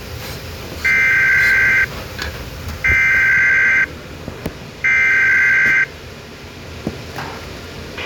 Emergency Alert System (SAME) tones (header bursts), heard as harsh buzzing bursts, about 520.83 baud, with a squelch burst at the end and kitchen noise.